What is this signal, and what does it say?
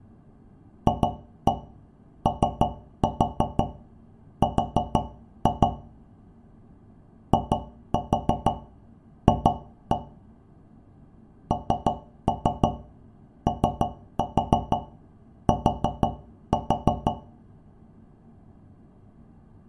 Tap code, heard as taps on a metal pipe, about 6 knocks a second, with room echo. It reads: FOR IF NOT